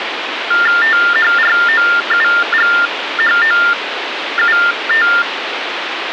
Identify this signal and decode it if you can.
TTY/TDD text telephone tones (45.45 baud Baudot), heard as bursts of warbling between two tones, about 400 Hz shift, 1600 Hz centre, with phone line noise. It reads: THROUGHOUT